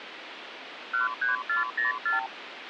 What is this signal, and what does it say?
Multi-frequency trunk signalling (R2, with the far end's replies), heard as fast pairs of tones, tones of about 140 ms, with phone line noise. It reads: 13404